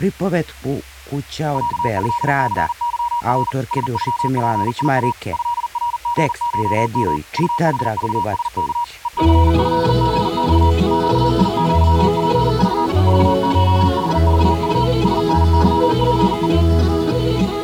Morse code (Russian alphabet), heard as a keyed tone, machine-sent, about 40 wpm, 950 Hz. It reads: ЯЭЦЫР СЮПИА ЭРГШМ УХЖСК ЕЦЭГЬ ЩИЪПЖ ЖШХЖУ СНЫПЕ